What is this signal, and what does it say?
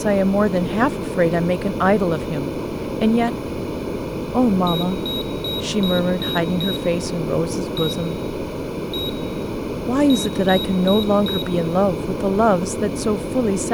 Beep code, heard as a piezo beeper, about 3800 Hz, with room echo and speech in English. 6-1-1-4.